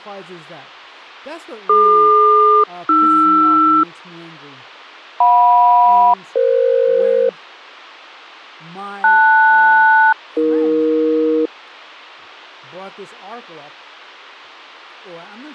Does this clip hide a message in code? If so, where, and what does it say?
Yes: aircraft SELCAL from 1.7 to 11.5 s, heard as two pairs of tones, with speech in English. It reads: DQ-AR JM-EF LS-AE